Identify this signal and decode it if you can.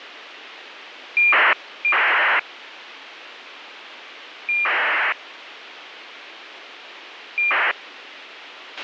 ACARS aircraft data, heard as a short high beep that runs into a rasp, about 2400 baud, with radio hiss and a squelch burst at the end.